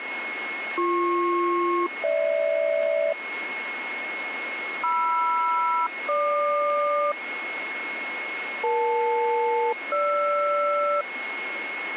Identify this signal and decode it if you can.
Aircraft SELCAL, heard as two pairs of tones, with radio static and a steady whistle near 2170 Hz. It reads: BP-GH MR-GQ EL-GR